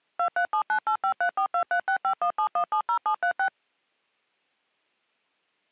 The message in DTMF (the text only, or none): 23798534236517170736